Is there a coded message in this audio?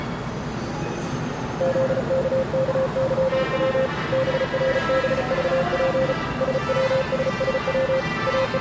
Yes: Morse code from 1.5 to 8.6 s, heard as a keyed tone, hand-sent with a paddle, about 35 wpm, 530 Hz, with the noise of a subway station. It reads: ZKKYW BRBVP SWSSW …